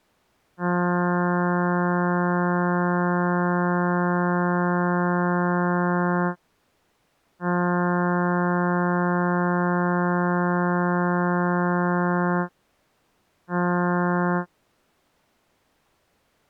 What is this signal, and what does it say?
Ship horn signal, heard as a ship's horn, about 180 Hz. 2 long, 1 short. At sea: I intend to overtake on your starboard side.